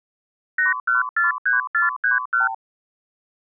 Multi-frequency trunk signalling (R2, with the far end's replies), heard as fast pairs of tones, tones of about 150 ms. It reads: 8143431